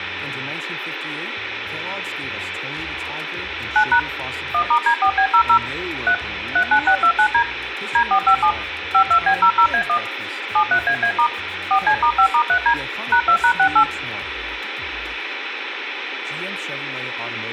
DTMF, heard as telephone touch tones, dialled by machine, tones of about 80 ms, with phone line noise and room echo. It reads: 9# 1*D4B00 3 39629D D457 52B00A1 73AA* 4C*5*3D #2#68